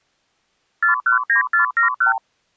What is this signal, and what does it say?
Multi-frequency trunk signalling (R2, with the far end's replies), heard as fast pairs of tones, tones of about 120 ms. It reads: 419471